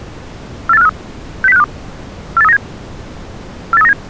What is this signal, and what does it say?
Five-tone selective call (EEA), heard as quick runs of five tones, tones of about 40 ms. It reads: 48453 60652 48397 48397